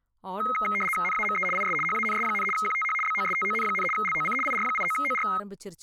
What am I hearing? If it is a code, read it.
RTTY (75 baud, 850 Hz shift), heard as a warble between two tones, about 1700 Hz centre, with speech in Tamil. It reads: NAME IS HANS, QTH BOSTON, LOC IR89OR